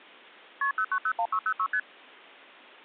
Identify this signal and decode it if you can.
Multi-frequency trunk signalling (R1, as on North American trunks), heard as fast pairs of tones, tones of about 70 ms. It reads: KP 0901606 ST